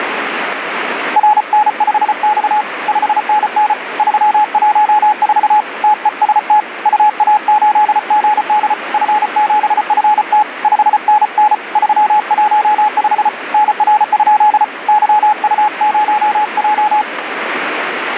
Morse code, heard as a keyed tone, hand-sent with a paddle, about 34 wpm, 850 Hz, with radio static. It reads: RN5X 5NN 314 TEST UA8GD F7FT 5NN 315 NR? YU0J